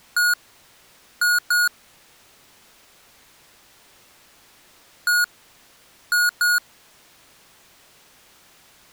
Beep code, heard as beeps from a small speaker, played twice, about 1440 Hz. 1-2.